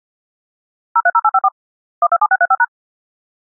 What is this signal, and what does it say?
DTMF, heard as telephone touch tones, dialled by machine, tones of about 50 ms. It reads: 030854 127635#